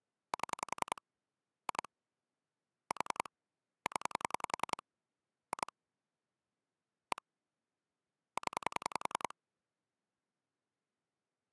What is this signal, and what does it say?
Pulse dialling, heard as clicks on a phone line, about 10 pulses a second. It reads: 7 2 4 0 2 1 0